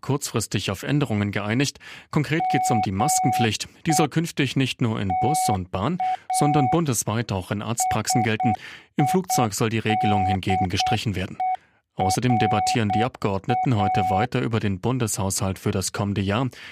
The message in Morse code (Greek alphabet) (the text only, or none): ΜΕ ΤΑ ΣΙΔΕΡΑ